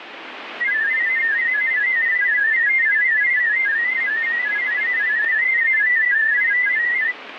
Multi-tone FSK (Olivia or MFSK type), about 500 Hz wide, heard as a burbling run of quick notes, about 31.25 baud, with radio static.